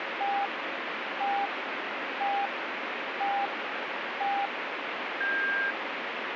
Radio time signal (five pips and a higher one, as on Chinese radio), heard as pips, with radio static.